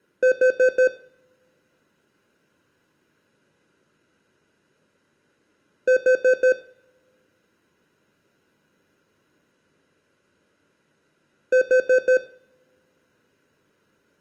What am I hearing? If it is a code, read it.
Alarm pattern, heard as an alarm's beeps, played three times, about 510 Hz, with room echo. Temporal four. Carbon monoxide.